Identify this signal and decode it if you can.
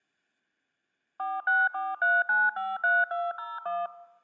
DTMF, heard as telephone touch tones, dialled by machine, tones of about 200 ms. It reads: 4643953201